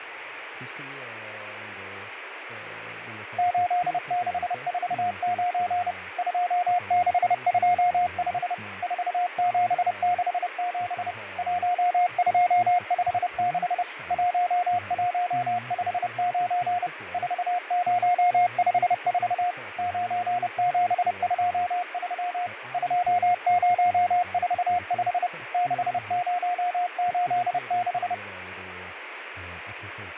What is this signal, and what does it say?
Morse code, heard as a keyed tone, machine-sent, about 30 wpm, 710 Hz, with radio static, fading and speech in Swedish. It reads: 8649 2625 4767 1256 1159 4054 9723 2045 6086